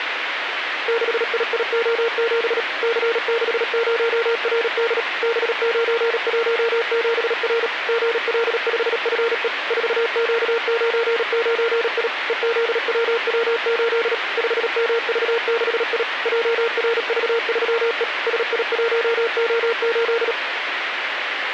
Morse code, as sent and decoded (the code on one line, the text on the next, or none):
-.... .. .. --- --... / -.-. -.... ----- .-. -.. / -... ----. .---- --... .-. / --. .-.. ..... ..-. . / ....- --.- ----. ----. .. / . --.. .-- .-- ---.. / ..... -- ...- -.... .. / .--- .-. ...- ...-- . / ... .. .---- --- ---..
6IIO7 C60RD B917R GL5FE 4Q99I EZWW8 5MV6I JRV3E SI1O8